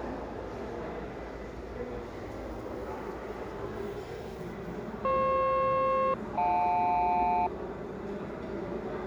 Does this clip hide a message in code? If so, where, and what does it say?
Yes: aircraft SELCAL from 5.0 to 7.5 s, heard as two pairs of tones, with the noise of a restaurant. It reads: FP-JL